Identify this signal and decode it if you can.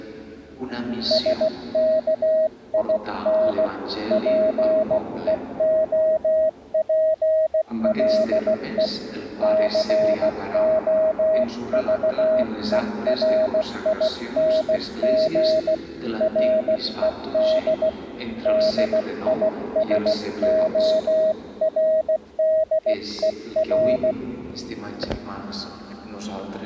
Morse code, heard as a keyed tone, hand-sent with a paddle, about 16 wpm, 630 Hz. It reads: SKIN PEOPLE COVERING RED DISORDER